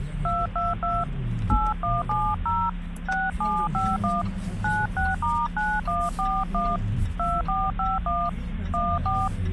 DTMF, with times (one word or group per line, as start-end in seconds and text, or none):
0.2-1.0 222
1.5-2.7 8170
3.1-4.2 6751
4.6-6.8 96*9141
7.2-8.3 2451
8.7-9.3 14